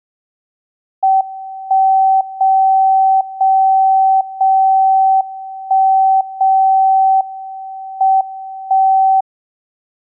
Radio time signal (WWVB), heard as a tone whose level steps once a second, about 770 Hz. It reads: 1 0 0 0 1 0 M 1